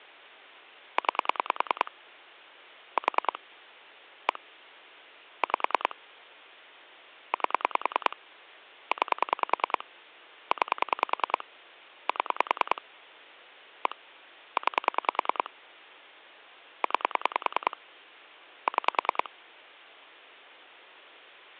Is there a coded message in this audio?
Yes: pulse dialling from 1.0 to 19.3 s, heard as clicks on a phone line, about 10 pulses a second, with hum. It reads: 9 4 1 5 8 9 9 7 1 9 9 6